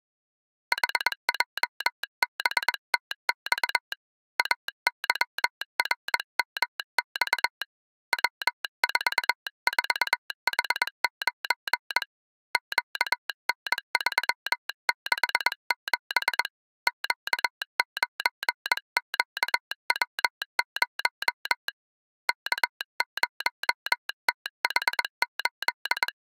Morse code, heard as a telegraph sounder, hand-sent with a paddle, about 21 wpm. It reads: HJBTX AYRMX W44H9 QN367 Q9QW0 K0TH8